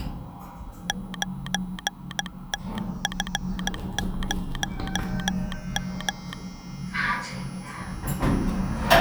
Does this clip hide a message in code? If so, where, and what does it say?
Yes: Morse code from 0.8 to 6.4 s, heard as a telegraph sounder, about 16 wpm, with the noise inside a lift. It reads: 9TF0M